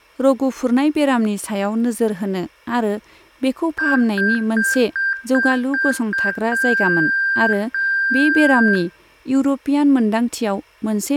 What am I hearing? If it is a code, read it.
Beep code, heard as beeps, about 1600 Hz, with room echo and speech in Bodo. 7 short, 2 long.